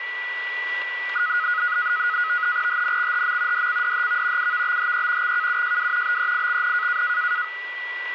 NAVTEX (SITOR-B), 100 baud, 170 Hz shift, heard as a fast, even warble, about 1360 Hz centre, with radio static and a steady whistle near 1960 Hz. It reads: HNXHM DCDHV UVBHE XKUJW BEIXN